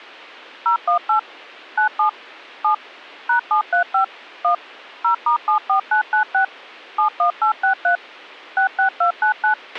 DTMF, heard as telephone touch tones, dialled by machine, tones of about 100 ms, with a squelch burst at the end. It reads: 018 97 7 #735 1 0*74996 71863 66299